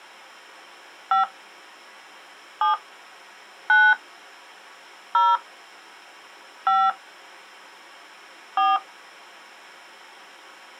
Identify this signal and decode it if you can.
DTMF, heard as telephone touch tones, dialled by hand, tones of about 160 ms. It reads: 5 7 9 0 5 4